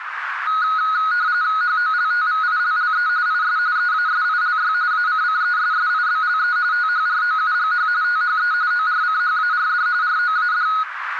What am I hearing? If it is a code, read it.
RTTY (45.45 baud, 170 Hz shift), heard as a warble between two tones, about 1360 Hz centre, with radio static and a narrow filter. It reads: HOLTVILLE IS EASILY ACCESSIBLE THROUGH THE ORCHARD ROAD